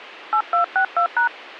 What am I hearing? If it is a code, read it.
DTMF, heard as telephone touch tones, dialled by hand, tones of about 90 ms. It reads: 8262#